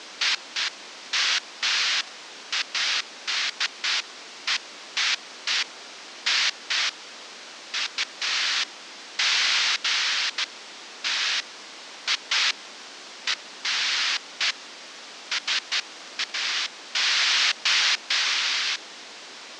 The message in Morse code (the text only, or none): none